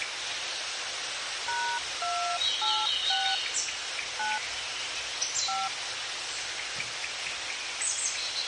DTMF, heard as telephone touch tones, dialled by hand, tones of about 290 ms, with phone line noise and the noise of a park. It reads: #286 9 5